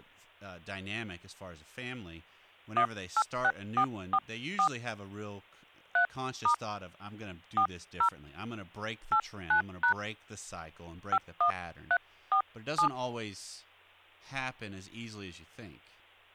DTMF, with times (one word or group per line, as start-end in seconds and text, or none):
2.8-4.7 186444
6.0-6.5 3*
7.6-8.1 40
9.1-9.9 89#
11.1-12.9 51347